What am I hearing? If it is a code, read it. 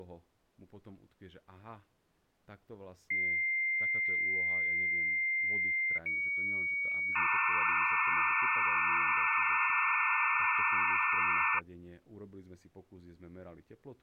Dial-up modem handshake (low-speed, two carriers), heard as two whistles, then hiss, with speech in Slovak.